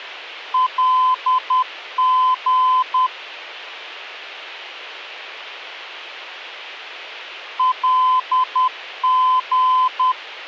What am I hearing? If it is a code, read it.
Morse code, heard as a keyed tone, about 10 wpm, 1020 Hz. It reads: LG LG